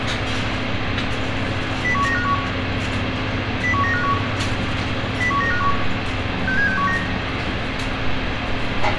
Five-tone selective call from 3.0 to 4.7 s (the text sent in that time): 01951